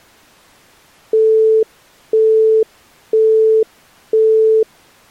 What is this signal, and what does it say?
Telephone call progress tone (single-tone plan, as in Europe, Japan and elsewhere), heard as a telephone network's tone, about 440 Hz, 0.5 s on and 0.5 s off. Busy tone.